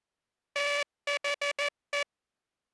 Morse code, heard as a buzzer, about 14 wpm. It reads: THE